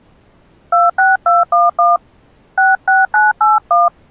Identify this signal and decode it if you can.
DTMF, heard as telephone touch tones, dialled by hand, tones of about 180 ms. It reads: 26211 66981